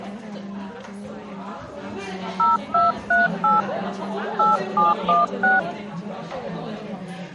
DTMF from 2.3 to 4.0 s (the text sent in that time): 0238